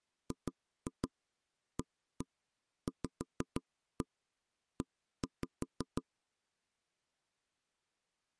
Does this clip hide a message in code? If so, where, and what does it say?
Yes: tap code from 0.3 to 6.0 s, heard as knocks on wood, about 6 knocks a second. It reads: GAVE